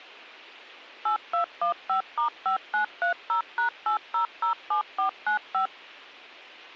DTMF, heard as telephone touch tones, dialled by machine, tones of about 110 ms. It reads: 8215*5930#8007495